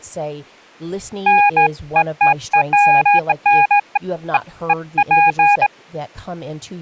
Beeps of irregular length, with speech in English. There is no code.